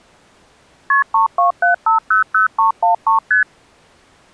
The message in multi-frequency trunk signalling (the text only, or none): KP 327500313 ST